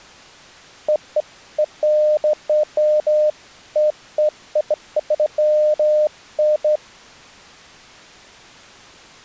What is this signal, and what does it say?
Beeps of irregular length. There is no code.